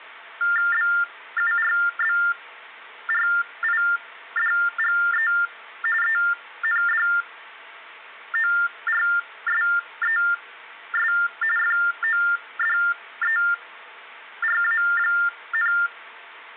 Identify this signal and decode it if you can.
TTY/TDD text telephone tones (45.45 baud Baudot), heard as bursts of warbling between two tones, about 400 Hz shift, 1600 Hz centre, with phone line noise. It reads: BURBRIDGE ENDORSES FODERA,